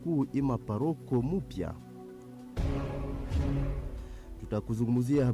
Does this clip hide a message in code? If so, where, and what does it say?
No.